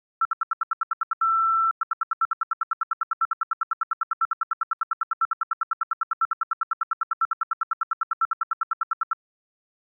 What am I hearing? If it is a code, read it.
Radio time signal (RWM, Moscow), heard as ten pulses a second.